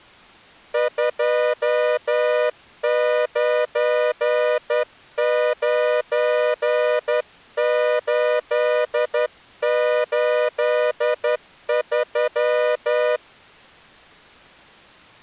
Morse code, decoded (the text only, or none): 299883